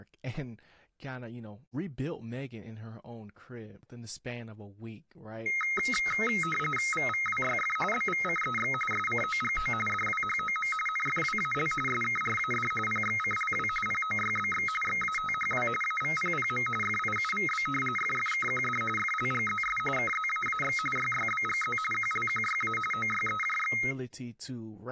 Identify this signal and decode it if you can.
RTTY (45.45 baud, 850 Hz shift), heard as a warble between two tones, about 1700 Hz centre, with speech in English. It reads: VVWYF BVCEX SCOGO DWHOM NFWAL SKRAD PXCLW POYBX XATHW AVPPM FIUVB FFKQD FLGZS KZAAX YYBGZ QLQYA OYEJX